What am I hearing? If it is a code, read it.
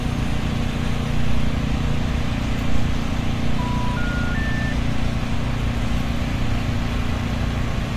Telephone call progress tone (North American plan), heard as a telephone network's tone, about 980, 1430, 1800 Hz, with phone line noise and street noise. Special information tone.